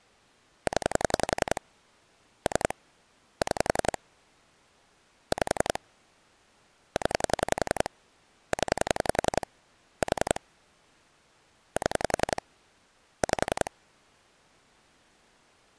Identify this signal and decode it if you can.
Pulse dialling, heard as clicks on a phone line, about 11 pulses a second. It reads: 0 3 6 5 0 0 4 7 5